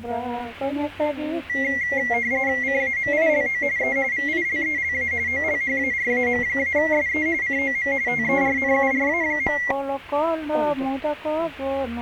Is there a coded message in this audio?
Yes: RTTY (45.45 baud, 170 Hz shift) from 1.5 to 9.7 s, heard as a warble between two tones, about 2050 Hz centre. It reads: CAMILO E VILELA OLHARAM-SE COM TERNURA.